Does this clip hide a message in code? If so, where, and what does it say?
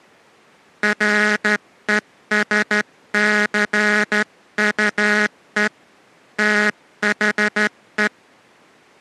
Yes: Morse code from 0.8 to 8.1 s, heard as a buzzer, hand-sent with a straight key, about 13 wpm. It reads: RESCUE THE